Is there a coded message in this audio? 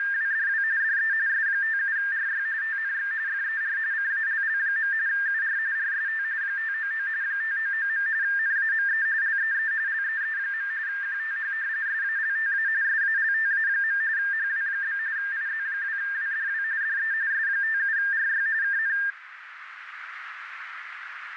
Yes: RTTY (45.45 baud, 170 Hz shift) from 0.0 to 19.1 s, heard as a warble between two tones, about 1700 Hz centre, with radio static and a narrow filter. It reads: … DE S57RY TNX FER CALL. UR RST 599 599. NAME LEE LEE. QTH SALTA SALTA. HW? IZ2WDW DE S57RY KN